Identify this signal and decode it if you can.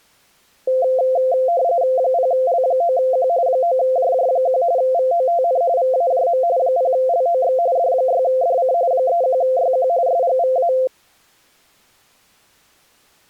RTTY (45.45 baud, 170 Hz shift), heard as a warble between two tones, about 600 Hz centre. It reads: 0L9Q 9JJ1 VOTN VAJM 0LOX D6DC 31YQ SGVA